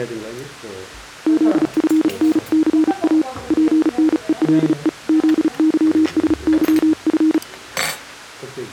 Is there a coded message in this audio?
Yes: Morse code (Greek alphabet) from 1.2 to 7.4 s, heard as a keyed tone, hand-sent with a paddle, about 35 wpm, 310 Hz, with the noise of a restaurant. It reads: ΖΦΝΘΑ ΠΝΕΛΕ ΖΥΣΥΦ